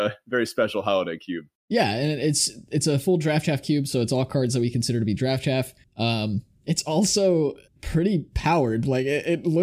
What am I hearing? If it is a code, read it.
Speech in English. There is no code.